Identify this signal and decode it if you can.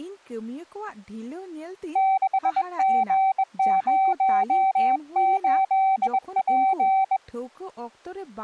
Morse code, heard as a keyed tone, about 21 wpm, 770 Hz, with speech in Santali. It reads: 6G08P